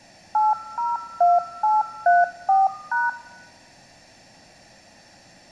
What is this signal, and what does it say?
DTMF, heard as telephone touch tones, dialled by machine, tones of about 180 ms, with room echo. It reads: 802834#